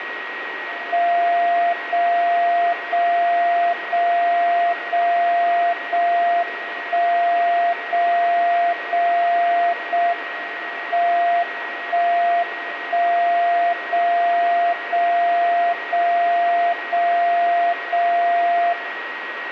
Radio time signal (JJY), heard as a tone whose level steps once a second, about 690 Hz, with radio static and a steady whistle near 1900 Hz. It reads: 0 0 0 0 0 1 0 0 0 M 1 1 0 0 0 0 0 0